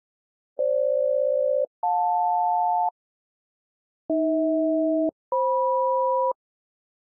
Aircraft SELCAL, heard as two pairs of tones. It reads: FG-JL AH-FM